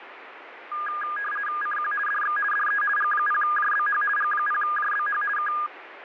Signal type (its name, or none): RTTY